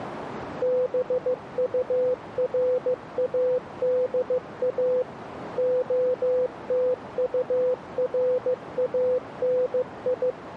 Morse code, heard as a keyed tone, machine-sent, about 15 wpm, 500 Hz, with radio static. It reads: BURADA OTURANI